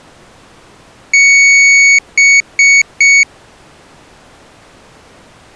Beep code, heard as a piezo beeper, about 2250 Hz. 1 long, 3 short. In Award and IBM BIOS tables: video adapter failure; in AMI BIOS tables: memory failure.